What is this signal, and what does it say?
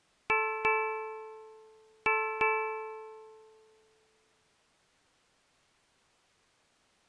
Ship's bell, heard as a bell. 4. Four half-hours of the watch have passed.